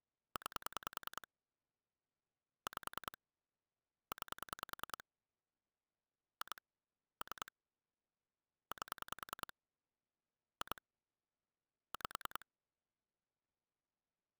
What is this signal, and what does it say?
Pulse dialling, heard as clicks on a phone line, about 10 pulses a second. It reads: 9 5 9 2 3 8 2 5